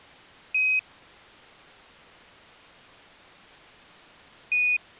Quindar tones, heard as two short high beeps.